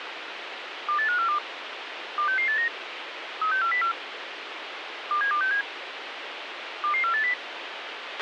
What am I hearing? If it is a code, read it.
Five-tone selective call (CCIR), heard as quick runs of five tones, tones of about 100 ms, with radio hiss and a squelch burst at the end. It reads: 28542 26689 36404 27267 22480